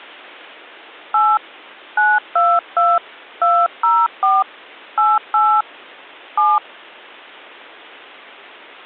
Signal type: DTMF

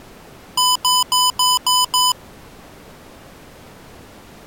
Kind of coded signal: beep code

